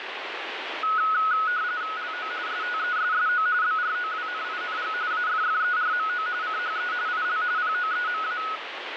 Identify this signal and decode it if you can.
RTTY (45.45 baud, 170 Hz shift), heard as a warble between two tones, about 1370 Hz centre, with radio static. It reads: LO STESSO BROWNING AFFERMO CHE IL POEMA